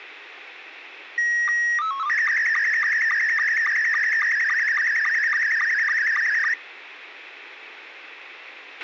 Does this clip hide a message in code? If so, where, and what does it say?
Yes: SSTV (slow-scan television), Scottie S2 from 1.2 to 6.5 s, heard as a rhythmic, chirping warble, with radio hiss and a squelch burst at the end.